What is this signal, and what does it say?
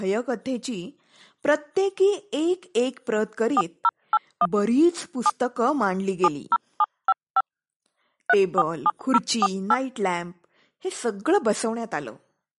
DTMF, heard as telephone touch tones, dialled by machine, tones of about 40 ms, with speech in Gujarati. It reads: 4081 7 70755 347048